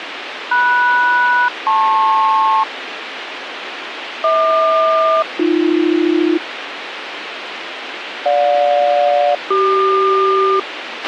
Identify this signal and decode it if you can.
Aircraft SELCAL, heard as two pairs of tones, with radio hiss and a squelch burst at the end. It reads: MS-LP HQ-AB GJ-CQ